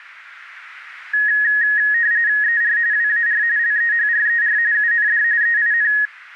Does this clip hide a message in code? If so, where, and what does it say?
Yes: RTTY (45.45 baud, 170 Hz shift) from 1.1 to 6.1 s, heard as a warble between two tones, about 1800 Hz centre, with radio static. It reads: ER WAR LEHRER UND EIN